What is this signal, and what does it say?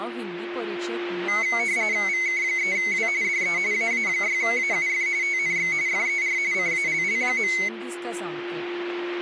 RTTY (45.45 baud, 170 Hz shift), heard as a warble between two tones, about 2150 Hz centre, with a steady whistle near 350 Hz and speech in Goan Konkani. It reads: VK3W DE AA6AUF TNX FER CALL.